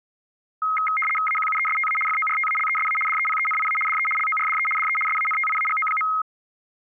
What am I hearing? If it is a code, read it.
RTTY (75 baud, 850 Hz shift), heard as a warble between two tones, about 1700 Hz centre. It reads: AQUESTA FORTALESA DEPENIA DE LORDE DE SANTIAGO.